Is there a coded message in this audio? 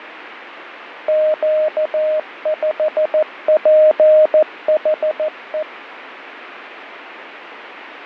Yes: Morse code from 1.0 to 5.7 s, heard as a keyed tone, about 14 wpm, 620 Hz, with radio static and fading. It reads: Q5PHE